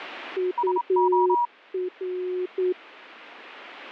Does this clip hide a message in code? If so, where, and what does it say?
Yes: Morse code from 0.3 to 2.8 s, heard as two keyed tones. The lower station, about 9 wpm, 360 Hz: UR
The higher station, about 27 wpm, 960 Hz: SO